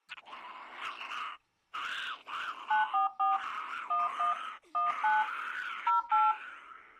DTMF, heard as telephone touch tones, dialled by hand, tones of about 180 ms. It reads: 944 11 19 08